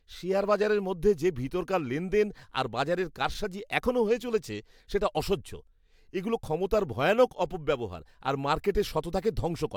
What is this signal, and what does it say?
Speech in Bangla. There is no code.